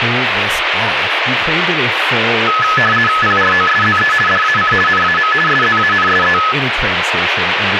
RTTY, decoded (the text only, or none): PROSZE DAC NAM SZANSE